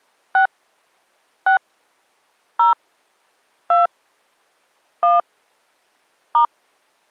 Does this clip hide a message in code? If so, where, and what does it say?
Yes: DTMF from 0.3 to 6.4 s, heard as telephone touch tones, dialled by hand, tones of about 130 ms. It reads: 6 6 0 2 1 *